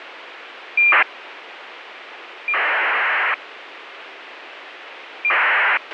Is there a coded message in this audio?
Yes: ACARS aircraft data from 0.8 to 5.8 s, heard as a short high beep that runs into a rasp, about 2400 baud, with radio hiss and a squelch burst at the end.